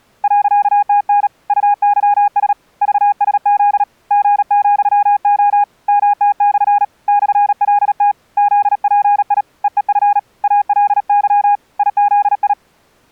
Morse code, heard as a keyed tone, hand-sent with a paddle, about 37 wpm, 820 Hz. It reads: .TN UYS VSZ G,O MT/ /LT ZPI EEF ALY IZI